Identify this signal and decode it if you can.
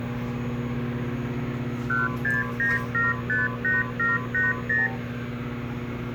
Multi-frequency trunk signalling (R2, with the far end's replies), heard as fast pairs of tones, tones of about 180 ms, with room echo and kitchen noise. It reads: 169758780